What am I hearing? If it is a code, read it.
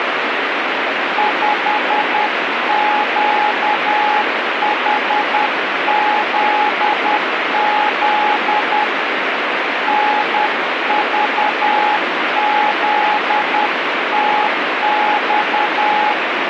Morse code, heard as a keyed tone, hand-sent with a paddle, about 10 wpm, 840 Hz, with radio static. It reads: 5QHZZ NVZTX